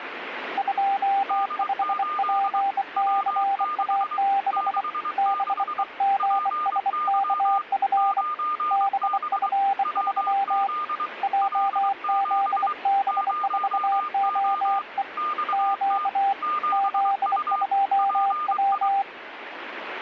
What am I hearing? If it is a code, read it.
Morse code, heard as two keyed tones, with radio static. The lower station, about 24 wpm, 790 Hz: 25PCA6 BEGSKF BF3 JZB4OE Q Z2W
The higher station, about 23 wpm, 1210 Hz: D8 W6 66 PY 9B WZ L7 0O XT 7U PI